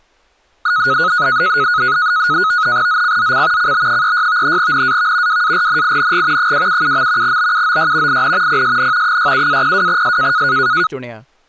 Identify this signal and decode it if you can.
NAVTEX (SITOR-B), 100 baud, 170 Hz shift, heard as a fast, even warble, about 1360 Hz centre, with speech in Punjabi. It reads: ZCZC CB36 NAV WARNING 277. BUOY IN PSN 67-02S